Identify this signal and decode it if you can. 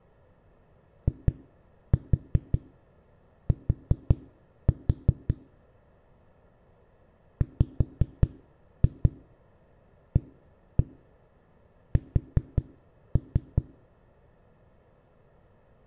Tap code, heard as knocks on a wall, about 5 knocks a second. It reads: IT WAS